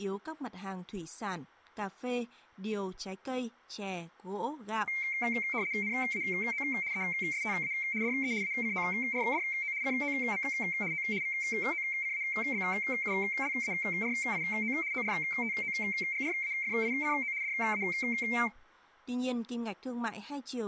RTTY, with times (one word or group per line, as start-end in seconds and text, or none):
5.8-6.6 NAO
6.9-7.7 ESTA
8.0-8.3 DE
8.4-9.7 ACORDO
9.8-10.4 COM
10.9-11.0 O
11.2-14.7 VOCABULARIO
14.9-17.3 ORTOGRAFICO
17.4-17.8 DA